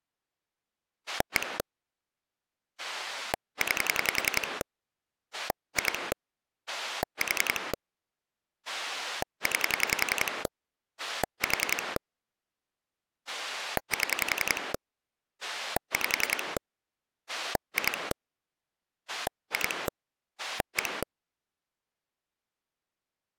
Pulse dialling, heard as a rotary dial, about 10 pulses a second. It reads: 1 9 2 4 9 4 7 5 2 2 1